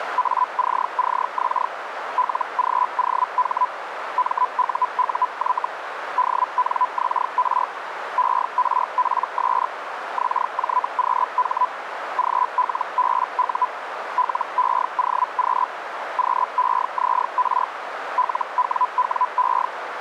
Hellschreiber (Feld-Hell, 122.5 baud), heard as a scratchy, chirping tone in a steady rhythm, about 1000 Hz, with radio static and a narrow filter. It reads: ACCX LGOH MUUY DNXR ERPS XJQH GLBU LEOQ QEZR LWWE